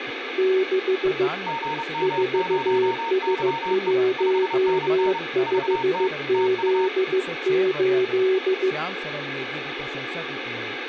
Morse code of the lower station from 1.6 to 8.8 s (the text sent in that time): 4S15Z8